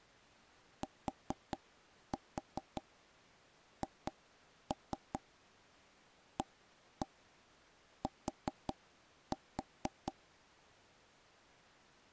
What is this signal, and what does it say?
Tap code, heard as taps on a table, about 4 knocks a second. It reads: THAT